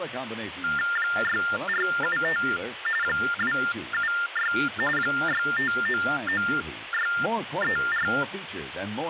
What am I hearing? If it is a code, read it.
TTY/TDD text telephone tones (45.45 baud Baudot), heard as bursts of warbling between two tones, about 400 Hz shift, 1600 Hz centre, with phone line noise and speech in English. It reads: 6475 276 6599634